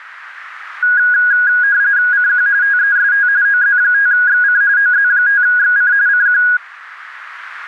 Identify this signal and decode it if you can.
RTTY (45.45 baud, 170 Hz shift), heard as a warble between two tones, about 1550 Hz centre, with radio static. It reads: CQ TEST OZ5XC OZ5XC CQ